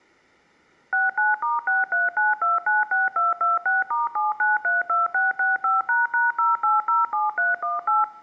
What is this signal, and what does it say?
DTMF, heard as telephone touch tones, dialled by machine, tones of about 170 ms. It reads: 69*639296226*7932665##0807318